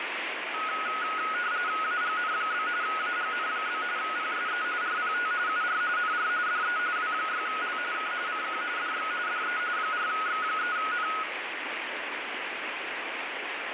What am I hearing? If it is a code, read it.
RTTY (45.45 baud, 170 Hz shift), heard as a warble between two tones, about 1360 Hz centre, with radio static. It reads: AGN? AGN? PSE RPT UR NR DE W6L K CQ DX DE 4X3N